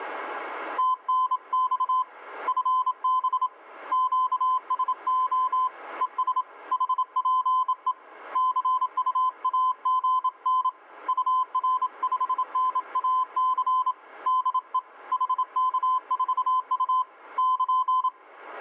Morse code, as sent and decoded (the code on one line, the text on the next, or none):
- -. -..- / ..-. -... / --.- ... --- / . ... / .... .--. . / -.-. ..- .- --. -. / ..- .-. ..... -. .- -.-. / -.. . / .... -.- ....- ..- / -.--.
TNX FB QSO ES HPE CUAGN UR5NAC DE HK4U <KN>